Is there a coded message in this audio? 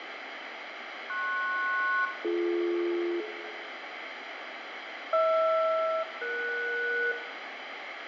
Yes: aircraft SELCAL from 1.1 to 7.1 s, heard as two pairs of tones, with radio static, fading and room echo. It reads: PS-BD HR-ES